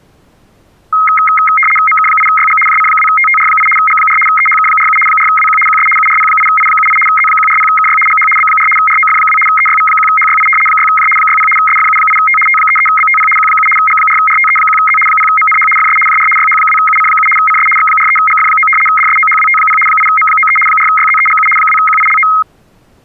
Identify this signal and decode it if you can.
RTTY (75 baud, 850 Hz shift), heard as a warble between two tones, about 1700 Hz centre. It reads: MK8YG JC2TTR8 G4 EHK47 4WQ QS URP8I78 Z140KY GH B4 ROF2 EYV1HYI 6J 60 SFU8T T33BTP Q7 G4RTE1Z 0MNH FS JR YH2UC7 CS X43GF9 DSOHWT0 8M93 4YZEGU 2QILO